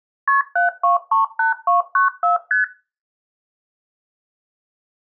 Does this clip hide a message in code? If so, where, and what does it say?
Yes: multi-frequency trunk signalling (R1, as on North American trunks) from 0.3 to 2.6 s, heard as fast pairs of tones, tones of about 140 ms. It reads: KP 7238294 ST